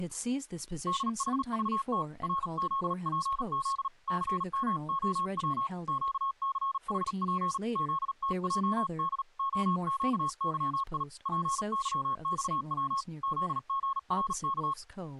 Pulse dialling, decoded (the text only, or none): none